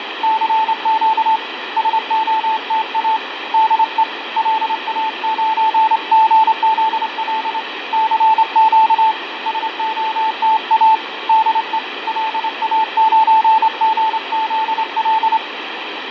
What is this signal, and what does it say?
Morse code, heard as a keyed tone, hand-sent with a straight key, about 27 wpm, 880 Hz, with radio static and fading. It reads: CQ SOTA DE LA9GZL CQ SOTA DE LA9GZL